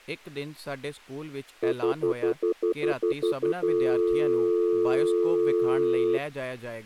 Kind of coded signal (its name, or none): telephone call progress tone